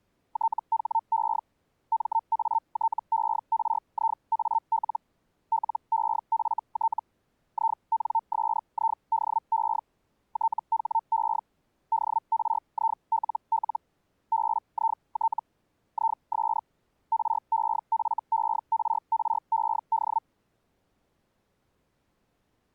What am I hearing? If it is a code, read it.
Hellschreiber (Feld-Hell, 122.5 baud), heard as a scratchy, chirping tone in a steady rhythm, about 900 Hz. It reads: THE MATERIAL LEFT INSIDE THE DRILL BIT IS REFERRED